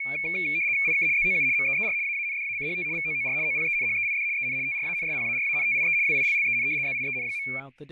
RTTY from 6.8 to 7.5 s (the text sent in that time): ZIEN.